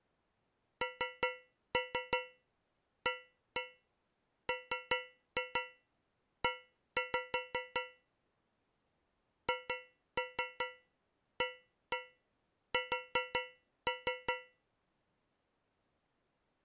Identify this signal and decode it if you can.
Tap code, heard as taps on a metal pipe, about 5 knocks a second. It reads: NAME HAS